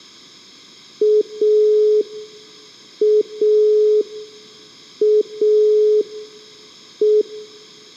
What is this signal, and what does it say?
Telephone call progress tone (pulsed, as in Italy), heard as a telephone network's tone, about 420 Hz, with room echo. Dial tone.